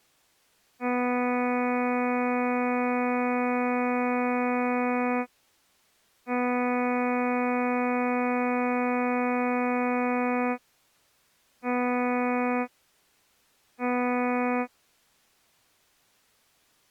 Ship horn signal, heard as a ship's horn, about 250 Hz. 2 long, 2 short. At sea: I intend to overtake on your port side.